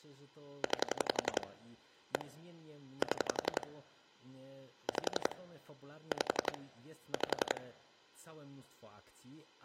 Pulse dialling, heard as clicks on a phone line, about 11 pulses a second, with speech in Polish. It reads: 9 1 7 5 5 5